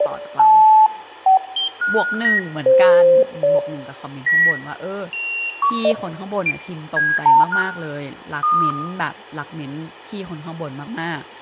Electronic bleeps of random pitch and length, with room echo and speech in Thai. There is no code.